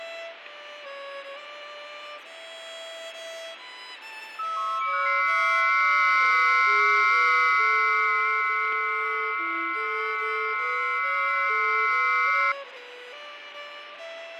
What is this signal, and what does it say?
FT8 (several signals at once), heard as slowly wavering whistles, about 6.25 baud, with radio static and fading.